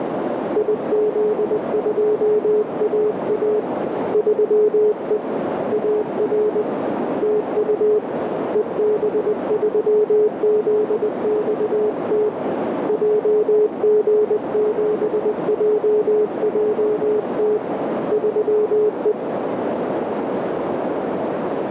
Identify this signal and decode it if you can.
Morse code, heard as a keyed tone, hand-sent with a paddle, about 20 wpm, 420 Hz, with heavy radio static and a narrow filter. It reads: IZ2AA 3E AR TU EB3ZXT JG7JJT 3E